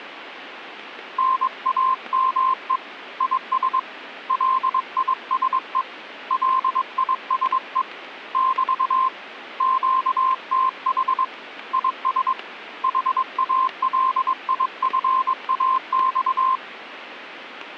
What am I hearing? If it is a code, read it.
Morse code, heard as a keyed tone, hand-sent with a paddle, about 22 wpm, 1050 Hz. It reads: NAME IS LISE LISE <BT> QTH IS HALIFAX